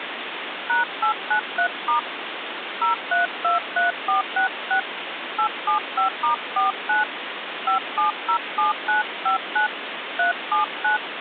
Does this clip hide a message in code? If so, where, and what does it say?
Yes: DTMF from 0.7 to 11.0 s, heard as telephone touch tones, dialled by hand, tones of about 120 ms, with phone line noise. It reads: #893* 0323466 875*49 5707959 379